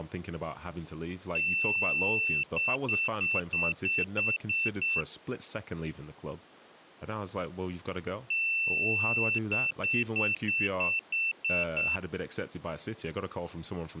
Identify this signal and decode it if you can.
Beep code, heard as a piezo beeper, played twice, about 2700 Hz, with speech in English. 1 long, 8 short. In AMI BIOS tables: display or retrace test failure.